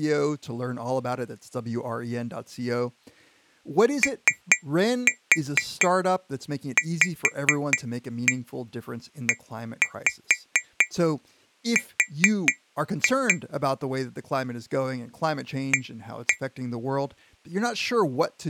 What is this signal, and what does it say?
Tap code, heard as taps on glass, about 4 knocks a second, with speech in English. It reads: OVER A